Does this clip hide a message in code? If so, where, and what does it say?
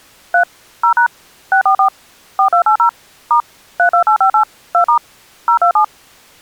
Yes: DTMF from 0.3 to 5.8 s, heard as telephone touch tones, dialled by machine, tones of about 100 ms. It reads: 3 0# 644 4280 * 32858 2* 027